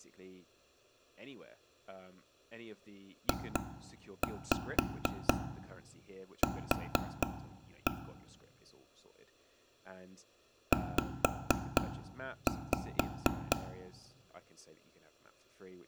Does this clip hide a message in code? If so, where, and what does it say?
Yes: tap code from 3.3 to 13.5 s, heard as taps on a table, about 4 knocks a second, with room echo and speech in English. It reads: JQ Z